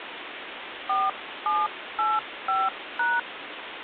DTMF, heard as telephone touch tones, dialled by hand, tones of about 200 ms, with phone line noise. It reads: 4785#